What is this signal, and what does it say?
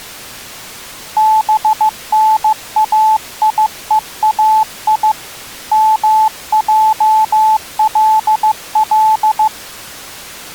Morse code (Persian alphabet), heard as a keyed tone, hand-sent with a paddle, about 15 wpm, 870 Hz. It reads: بنایهای مجلل